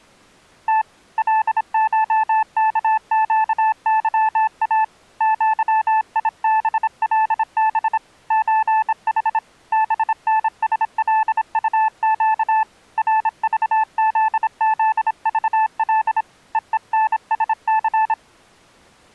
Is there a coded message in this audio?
Yes: Morse code (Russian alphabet) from 0.6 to 18.2 s, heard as a keyed tone, hand-sent with a bug key, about 26 wpm, 880 Hz. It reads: Т ЛШКЩЫА ЪИБЛБ ЧХ БНСЛУЩ РЖЗЗЖЛ ЕЕНСЦ